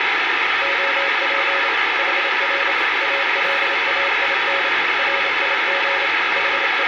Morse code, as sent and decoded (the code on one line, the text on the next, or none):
--- .--. / .... .-. / .- .-.. .- .. -. / .-. .. --. / …
OP HR ALAIN RIG …